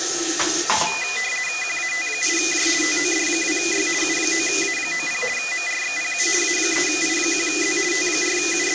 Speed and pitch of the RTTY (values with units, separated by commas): 50 baud, 450 Hz shift, 2250 Hz centre